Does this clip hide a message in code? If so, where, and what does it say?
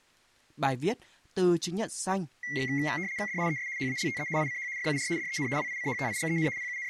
Yes: RTTY (75 baud, 170 Hz shift) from 2.4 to 6.9 s, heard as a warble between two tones, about 2050 Hz centre, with speech in Vietnamese. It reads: DIES HALTE ICH FUR DEN WICHTIGEN …